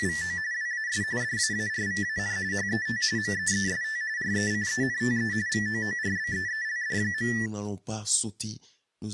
RTTY (45.45 baud, 170 Hz shift), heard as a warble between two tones, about 1850 Hz centre, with speech in French. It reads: … WAS DAARVAN HET MEEST RECENTE VOORBEELD.